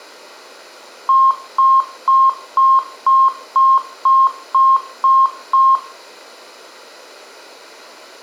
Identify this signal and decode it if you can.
Beep code, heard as beeps, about 1070 Hz, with room echo. 10 short. In AMI BIOS tables: CMOS shutdown register error.